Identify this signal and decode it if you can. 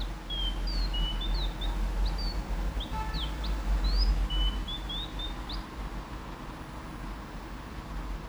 Bird-like chirps, with room echo and the noise inside a lift. There is no code.